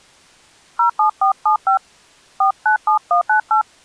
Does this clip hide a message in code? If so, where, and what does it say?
Yes: DTMF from 0.8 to 3.6 s, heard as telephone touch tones, dialled by hand, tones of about 110 ms. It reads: 07475 497198